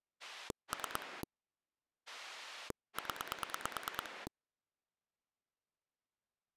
Pulse dialling, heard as a rotary dial, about 9 pulses a second. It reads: 3 0